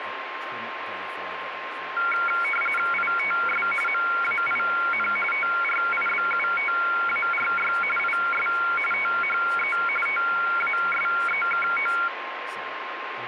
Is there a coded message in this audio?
Yes: RTTY (45.45 baud, 850 Hz shift) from 2.0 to 12.1 s, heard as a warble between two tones, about 1800 Hz centre, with radio static, a steady whistle near 1060 Hz and speech in English. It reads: ITS MAIN TRIBUTARY IS THE TASEKO